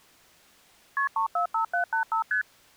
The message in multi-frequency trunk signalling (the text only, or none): KP 345785 ST